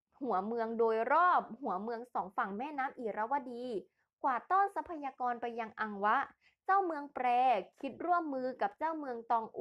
Speech in Thai. There is no code.